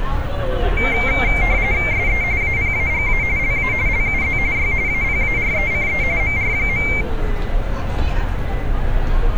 RTTY (45.45 baud, 170 Hz shift), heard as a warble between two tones, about 2200 Hz centre, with street noise. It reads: SE APAGA LA LUZ Y APARECE MR.